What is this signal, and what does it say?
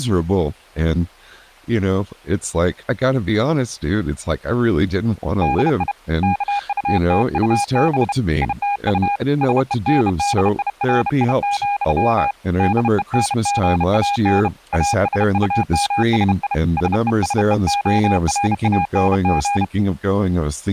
Morse code, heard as a keyed tone, hand-sent with a bug key, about 31 wpm, 810 Hz, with speech in English. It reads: DI KUTUB ITU SENDIRI, DENGAN ASUMSI SESEORANG